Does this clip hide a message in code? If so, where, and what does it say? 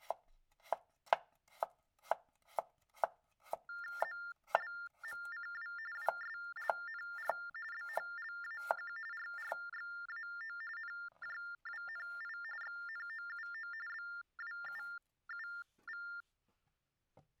Yes: TTY/TDD text telephone tones (45.45 baud Baudot) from 3.7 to 16.2 s, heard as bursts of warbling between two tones, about 400 Hz shift, 1600 Hz centre. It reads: ZLMCW WSLNR BHLAQ RRXAO NJWNI XNOUO BWUUV